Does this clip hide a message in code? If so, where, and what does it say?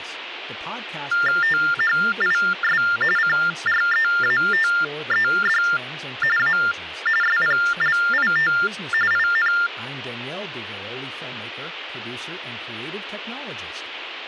Yes: TTY/TDD text telephone tones (45.45 baud Baudot) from 1.1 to 9.7 s, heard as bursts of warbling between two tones, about 400 Hz shift, 1600 Hz centre, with phone line noise and speech in English. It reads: THIS CREATED A SPLIT IN